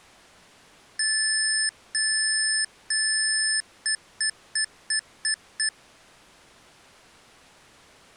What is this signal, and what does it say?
Beep code, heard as beeps from a small speaker, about 1750 Hz. 3 long, 6 short.